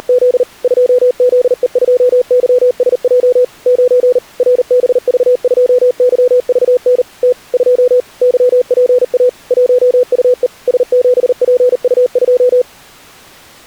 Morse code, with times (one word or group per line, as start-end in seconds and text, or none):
0.0-0.4 …
0.6-3.4 2ZE2YSJ
3.7-4.2 9
4.4-7.0 RBV2YVN
7.2-7.3 T
7.5-8.0 2
8.2-9.3 YPA
9.5-10.5 1UE
10.7-12.6 S7PU2